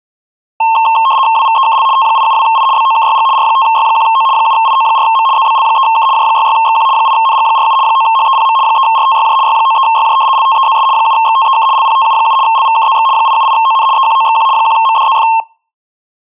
RTTY (75 baud, 170 Hz shift), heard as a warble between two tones, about 980 Hz centre. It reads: WVEKL T872I BOKYG R5Y1O 7IO4M ZBL3K J66XQ 8NG47 9HEPM 3RTYJ Y93YJ LTEZS 7XTEK LPTU7 LVKZX 878ON EQOXQ 1MDZF